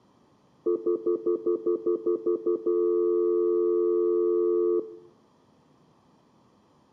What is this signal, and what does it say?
Telephone call progress tone (North American plan), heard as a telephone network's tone, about 350, 440 Hz, 0.1 s on and 0.1 s off, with room echo. Stutter dial tone.